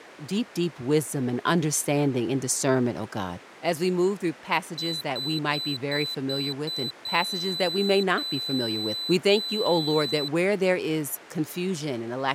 Beep code, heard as a piezo beeper, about 4000 Hz, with speech in English. 6 short, 3 long.